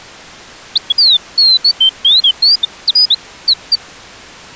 Bird-like chirps. There is no code.